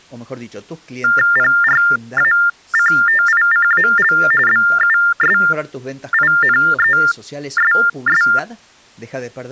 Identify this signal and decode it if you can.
TTY/TDD text telephone tones (45.45 baud Baudot), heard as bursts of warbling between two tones, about 400 Hz shift, 1600 Hz centre, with speech in Spanish. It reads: PRACTICAL BUSINESS